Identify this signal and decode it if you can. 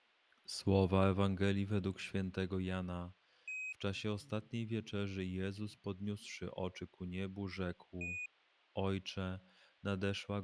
Quindar tones, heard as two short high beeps, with a squelch burst at the end and speech in Polish.